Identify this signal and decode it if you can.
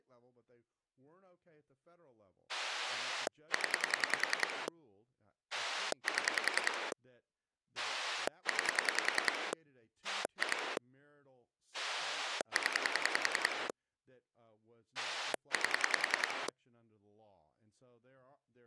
Pulse dialling, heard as a rotary dial, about 10 pulses a second, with speech in English. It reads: 0 7 9 2 0 8